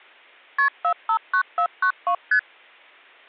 Multi-frequency trunk signalling (R1, as on North American trunks), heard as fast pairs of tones, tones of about 80 ms. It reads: KP 459492 ST